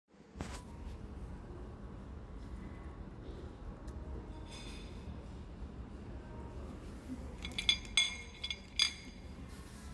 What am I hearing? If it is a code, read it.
The noise of a cafe. There is no code.